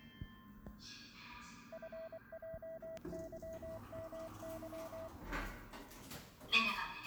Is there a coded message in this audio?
Yes: Morse code (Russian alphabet) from 1.7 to 5.1 s, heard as a keyed tone, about 24 wpm, 650 Hz, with the noise inside a lift. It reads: ФЙЫМЫ